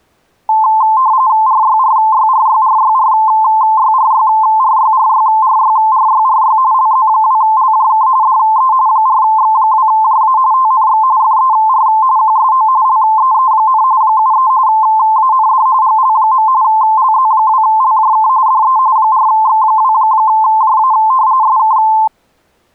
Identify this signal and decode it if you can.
RTTY (45.45 baud, 170 Hz shift), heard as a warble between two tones, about 960 Hz centre. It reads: RYRYRYRYRYRYRYRYRYRYRY LZ2LJK DE 4X2JA TNX FER QSO LEE, 73 AND GL. LZ2LJK DE 4X2JA SK